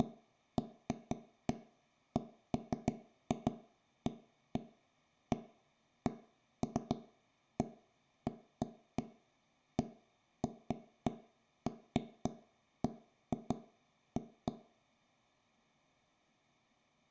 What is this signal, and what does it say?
Irregular taps on a table, with room echo. There is no code.